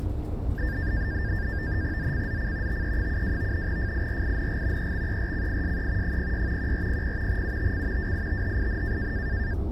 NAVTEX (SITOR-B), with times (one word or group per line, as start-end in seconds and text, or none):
2.0-2.8 ZCZC
2.7-3.7 TE72
3.7-4.9 FIRING
4.8-6.2 EXERCISE
6.0-6.7 06
6.6-7.4 1400
7.3-8.1 UTC
8.0-9.1 WITHIN